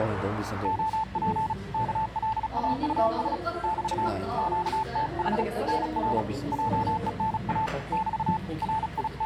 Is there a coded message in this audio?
Yes: Morse code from 0.6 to 9.3 s, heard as a keyed tone, hand-sent with a paddle, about 36 wpm, 880 Hz, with the noise of a cafe. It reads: OP KLAUS <BT> QTH NR JENA <BT> …